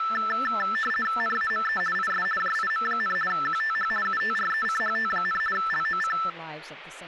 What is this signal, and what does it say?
RTTY (50 baud, 450 Hz shift), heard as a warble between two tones, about 1550 Hz centre, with speech in English. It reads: NAME IS JIM, QTH UTRECHT, LOC